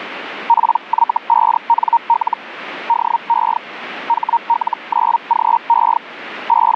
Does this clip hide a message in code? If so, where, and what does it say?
Yes: Hellschreiber (Feld-Hell, 122.5 baud) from 0.5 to 6.8 s, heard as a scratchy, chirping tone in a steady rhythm, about 930 Hz. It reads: PY5NL DE HL9GE …